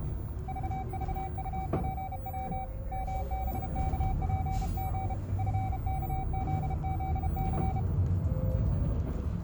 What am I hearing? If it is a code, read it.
Morse code, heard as a keyed tone, hand-sent with a bug key, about 32 wpm, 760 Hz, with the noise inside a bus. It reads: VVUPW MBKPG FKZZC